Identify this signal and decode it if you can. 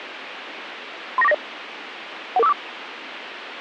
Five-tone selective call (EIA), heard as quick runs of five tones, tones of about 30 ms, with radio hiss. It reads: 39490 11454